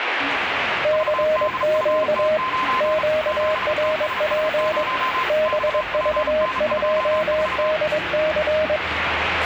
Morse code, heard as two keyed tones, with radio static and the noise of a park. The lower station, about 22 wpm, 620 Hz: CQ QRP BV2DC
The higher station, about 35 wpm, 1030 Hz: VDFT9 7TSS0 XPN24